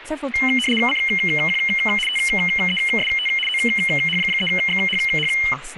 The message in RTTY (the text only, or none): CQ TEST OH3XHH